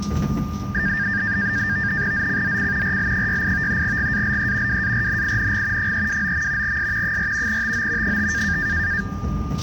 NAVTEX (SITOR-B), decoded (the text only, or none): ZCZC RL68 GALE WARNING 329. S 4 TO 5